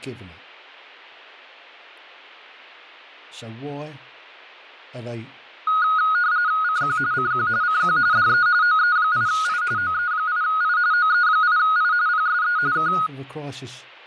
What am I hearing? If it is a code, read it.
RTTY (45.45 baud, 170 Hz shift), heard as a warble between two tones, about 1350 Hz centre, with speech in English. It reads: CQ CQ CQ DE OE8I OE8I OE8I PSE K